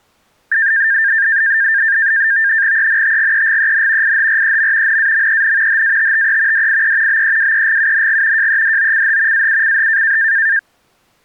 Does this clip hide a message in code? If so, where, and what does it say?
Yes: NAVTEX (SITOR-B), 100 baud, 170 Hz shift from 0.5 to 10.6 s, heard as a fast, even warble, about 1700 Hz centre. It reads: ENTGEGEN IHREM NAMEN HATTE DIE BEWEGUNG JEDOCH AUCH